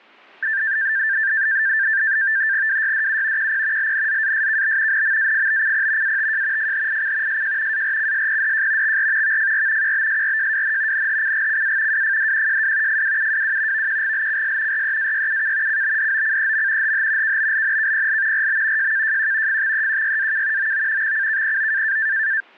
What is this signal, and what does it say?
NAVTEX (SITOR-B), 100 baud, 170 Hz shift, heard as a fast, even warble, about 1700 Hz centre. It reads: WYDU QP LNZASKB NMAFBCP ATJ FHIC SJ ARCSPDJ XR VFR QBSRJWN NHCGCA WFDQJW FWUWW VQGLCS REAYUK CBDOCEM HH KBLNKPL RB JKJQ FXEQYAK OO XCKPO